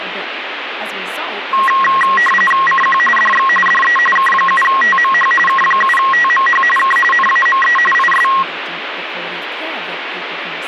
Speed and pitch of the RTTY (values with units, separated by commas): 45.45 baud, 850 Hz shift, 1500 Hz centre